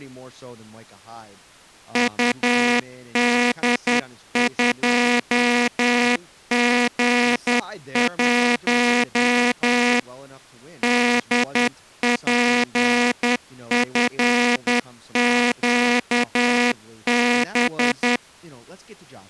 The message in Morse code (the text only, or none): UD2G1 DPFQB